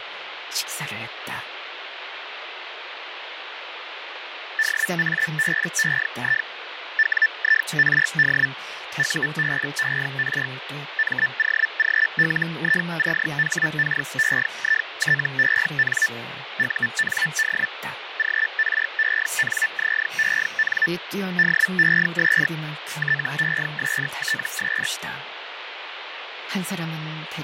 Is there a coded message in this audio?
Yes: Hellschreiber (Feld-Hell, 122.5 baud) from 4.6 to 24.9 s, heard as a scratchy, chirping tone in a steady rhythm, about 1750 Hz, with radio static and speech in Korean. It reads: DABEI WIRD UBER MOGLICHKEITEN UND GRENZEN DES TESTS